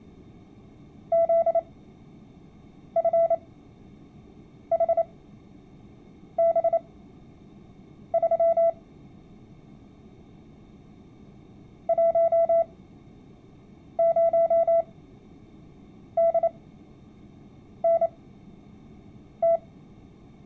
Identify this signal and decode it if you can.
Morse code, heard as a keyed tone, machine-sent, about 28 wpm, spaced as for 6 wpm, 670 Hz. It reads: ZFHB3 10DNT